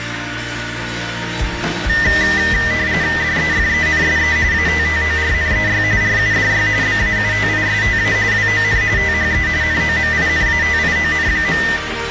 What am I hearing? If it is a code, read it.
RTTY (45.45 baud, 170 Hz shift), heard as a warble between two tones, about 1900 Hz centre, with radio static and a narrow filter. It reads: DEFENSE ATTORNEY RUDY BAUTISTA WON THE NOMINATION.